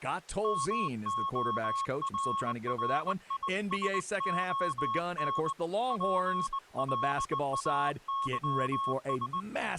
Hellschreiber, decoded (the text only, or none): none